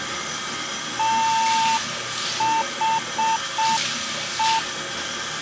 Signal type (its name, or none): Morse code